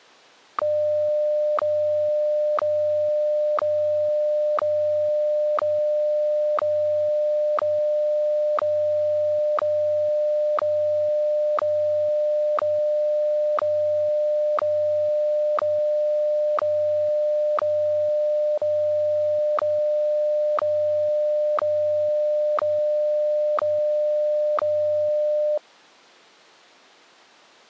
Radio time signal (WWVH, Hawaii), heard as ticks, one a second.